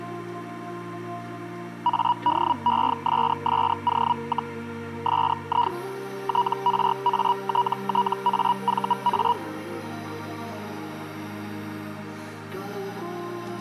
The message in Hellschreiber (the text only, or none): ADESSO, SI TRATTAVA